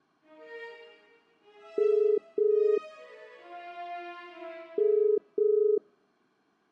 Telephone call progress tone (as in the UK, Ireland, Australia and similar networks), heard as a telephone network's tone, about 430 Hz. Ringback tone.